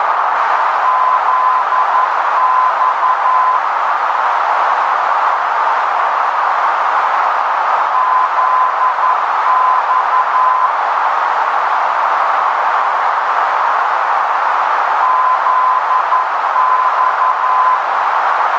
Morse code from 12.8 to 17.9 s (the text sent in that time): ZX